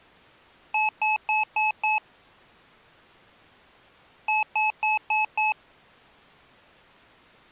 Beep code, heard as beeps from a small speaker, played twice, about 860 Hz. 5 short. In AMI BIOS tables: processor failure; in Dell tables: CMOS battery failure.